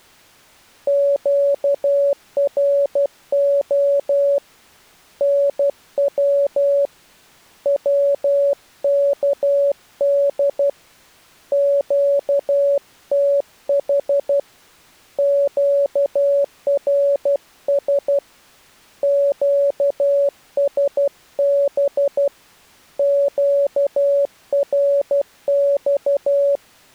Morse code, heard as a keyed tone, hand-sent with a paddle, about 12 wpm, 560 Hz. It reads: QRO NW WKD QTH QRS QSB QRX